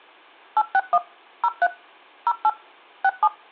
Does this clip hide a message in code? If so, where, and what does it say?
Yes: DTMF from 0.6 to 3.3 s, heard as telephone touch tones, dialled by machine, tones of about 50 ms, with room echo. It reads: 861 03 08 67